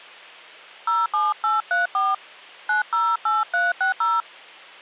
DTMF, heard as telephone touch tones, dialled by hand, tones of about 170 ms, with hum. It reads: 07834 908360